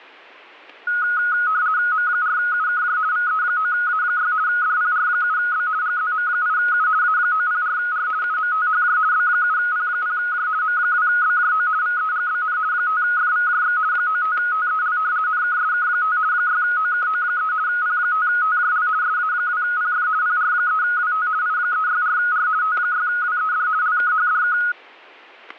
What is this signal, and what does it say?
RTTY (50 baud, 170 Hz shift), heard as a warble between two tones, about 1360 Hz centre, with static crashes. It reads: M4UKJ VE9A6 DPR7B GZM8U A904R UMTHJ B7P0J M2BJO VEGBN 5FVJX 95TEL NKSK5 6OKO3 P5TJL SA2PF PR3WT I364R T6WED LKHDK